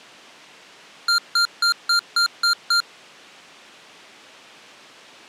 Beep code, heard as beeps from a small speaker, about 1390 Hz. 7 short. In AMI BIOS tables: virtual mode exception error; in Dell tables: processor failure.